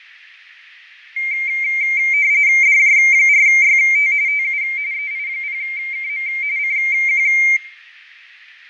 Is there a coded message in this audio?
Yes: RTTY (45.45 baud, 170 Hz shift) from 1.2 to 7.6 s, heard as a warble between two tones, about 2200 Hz centre, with radio static and fading. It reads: DJ4YT TU EI0KM CQ